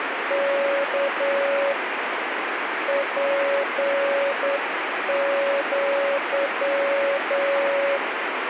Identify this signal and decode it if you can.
Morse code (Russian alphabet), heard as a keyed tone, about 9 wpm, 560 Hz, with radio static. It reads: К ПЪ